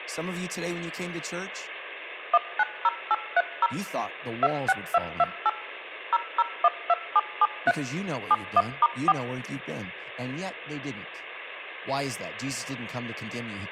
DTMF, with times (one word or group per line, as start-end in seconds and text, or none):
2.3-3.7 190830
4.4-5.5 26228
6.1-7.7 0012773
8.3-9.1 71*4